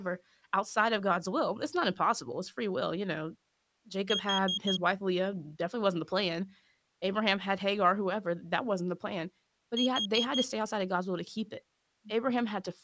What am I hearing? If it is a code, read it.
Alarm pattern, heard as an alarm's beeps, played twice, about 3250 Hz, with speech in English. Temporal four. Carbon monoxide.